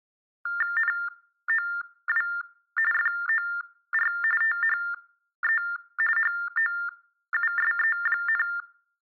TTY/TDD text telephone tones (45.45 baud Baudot), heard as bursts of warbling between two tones, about 400 Hz shift, 1600 Hz centre. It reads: NOW FOR THE HOUSE,